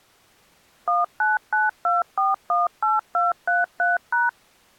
DTMF, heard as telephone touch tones, dialled by machine, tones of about 170 ms. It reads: 1992418233#